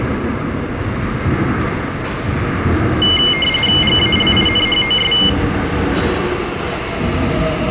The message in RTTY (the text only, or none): GALINHOS